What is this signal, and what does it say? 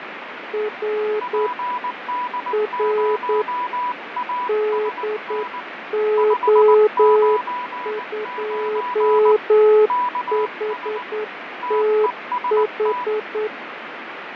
Morse code, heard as two keyed tones, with radio static and fading. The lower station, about 9 wpm, 430 Hz: R R DO2HTH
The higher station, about 19 wpm, 990 Hz: PD0ASN 599 KS TEST